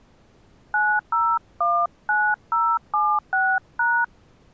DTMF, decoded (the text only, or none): 9019076#